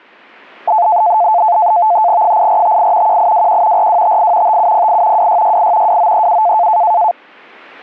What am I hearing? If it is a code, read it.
NAVTEX (SITOR-B), 100 baud, 170 Hz shift, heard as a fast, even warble, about 780 Hz centre. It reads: 8458 1821 4258 5708 2668 2937